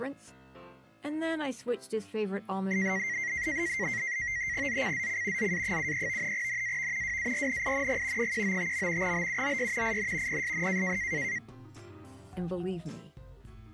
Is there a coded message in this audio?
Yes: NAVTEX (SITOR-B), 100 baud, 170 Hz shift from 2.7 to 11.4 s, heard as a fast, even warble, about 2000 Hz centre. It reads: ZCZC ZA73 NAV WARNING 195. BUOY IN PSN